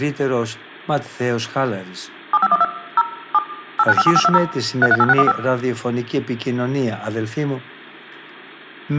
DTMF, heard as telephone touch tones, dialled by machine, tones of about 40 ms, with room echo and speech in Greek. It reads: 7512 0 7 8957520 338615